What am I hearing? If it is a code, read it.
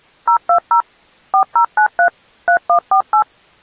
DTMF, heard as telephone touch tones, dialled by machine, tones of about 90 ms. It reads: 020 4093 3148